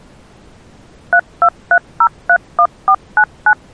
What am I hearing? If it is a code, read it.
DTMF, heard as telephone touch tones, dialled by machine, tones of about 70 ms. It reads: 323031499